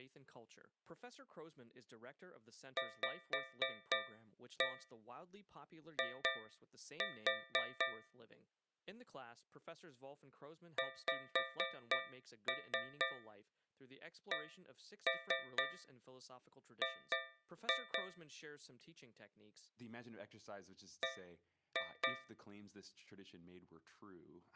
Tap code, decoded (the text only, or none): VI XCG B